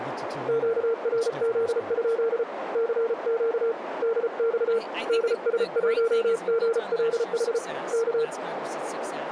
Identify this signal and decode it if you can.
Morse code, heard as a keyed tone, hand-sent with a paddle, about 34 wpm, 460 Hz, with radio static, a narrow filter and speech in English. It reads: QRZ? CQ DX DS1GLH K